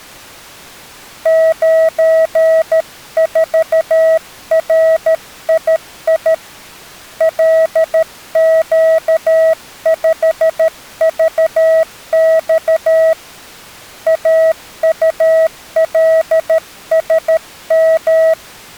Morse code, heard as a keyed tone, hand-sent with a paddle, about 13 wpm, 650 Hz. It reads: 94RII LQ5VX AULSM